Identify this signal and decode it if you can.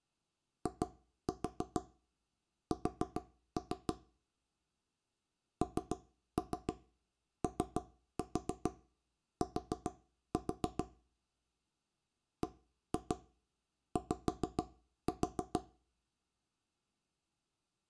Tap code, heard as knocks on wood, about 6 knocks a second, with room echo. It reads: IS NOT BY